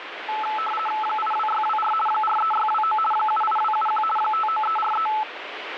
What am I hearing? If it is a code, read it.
RTTY (50 baud, 450 Hz shift), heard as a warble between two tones, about 1090 Hz centre, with radio static. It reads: 82624 43629 78271 59343